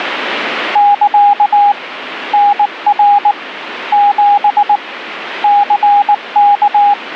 Morse code, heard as a keyed tone, hand-sent with a paddle, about 19 wpm, 820 Hz, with radio static. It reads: <KA> NR 7 CK